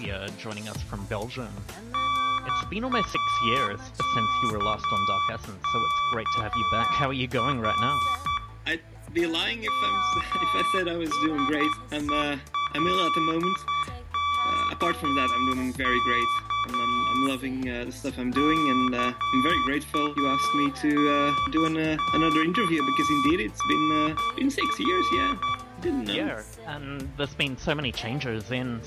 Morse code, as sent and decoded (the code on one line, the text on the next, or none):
-. .- -.- -.- .-. / -- ... . .-.. -.- -.- / -.- .- -. -.- -. .-.
NAKKR MSELKK KANKNR